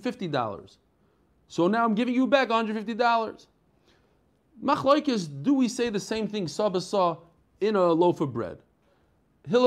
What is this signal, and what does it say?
Speech in English. There is no code.